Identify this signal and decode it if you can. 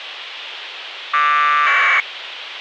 Packet radio (AX.25, as in APRS), 1200 baud, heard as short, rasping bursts, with radio hiss.